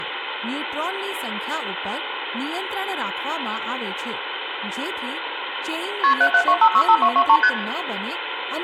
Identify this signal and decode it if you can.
Multi-frequency trunk signalling (R1, as on North American trunks), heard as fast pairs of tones, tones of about 70 ms, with phone line noise, room echo and speech in Gujarati. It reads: KP 772565223 ST